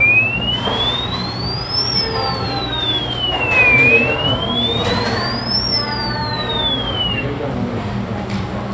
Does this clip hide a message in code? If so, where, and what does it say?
No, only a tone that sweeps in pitch again and again, with the noise of a cafe.